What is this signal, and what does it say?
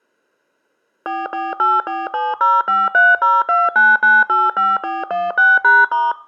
DTMF, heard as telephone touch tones, dialled by machine, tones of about 200 ms. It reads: 44847053029985416#*